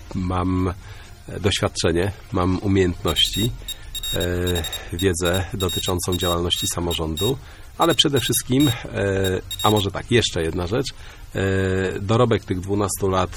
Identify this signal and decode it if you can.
Morse code, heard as a high beeper, machine-sent, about 28 wpm, spaced as for 22 wpm, 3750 Hz. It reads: VERHEIRATET IST ER